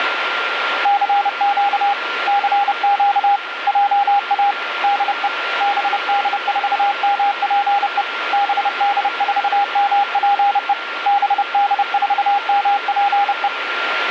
Morse code, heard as a keyed tone, hand-sent with a paddle, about 30 wpm, 810 Hz, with radio static and a steady whistle near 1390 Hz. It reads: CQ CQ JA DE BD4MPE BD4MPE BD4MPE